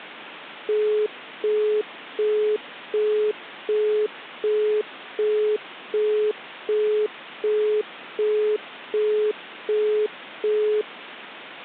Telephone call progress tone (as in the UK, Australia and similar networks), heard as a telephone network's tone, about 420 Hz, 0.375 s on and 0.375 s off. Busy tone.